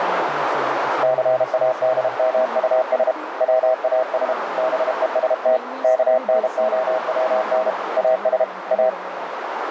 Morse code, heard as a keyed tone, hand-sent with a paddle, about 32 wpm, 640 Hz, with heavy radio static, a narrow filter and speech in English. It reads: CADMUS WAS BEST KNOWN AS A